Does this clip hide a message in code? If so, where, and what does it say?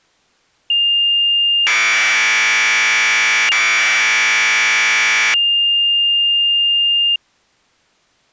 Yes: Commodore tape loading (standard loader) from 0.7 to 7.2 s, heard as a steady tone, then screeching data.